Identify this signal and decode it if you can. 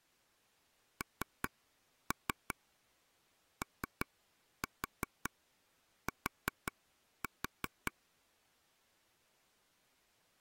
Tap code, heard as taps on a table, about 5 knocks a second. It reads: NOT